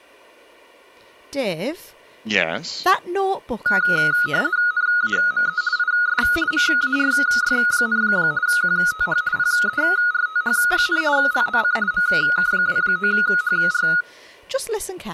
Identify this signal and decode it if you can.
RTTY (50 baud, 170 Hz shift), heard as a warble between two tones, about 1360 Hz centre, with room echo and speech in English. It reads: NAME IS MARY, QTH PERTH, LOC MK29HR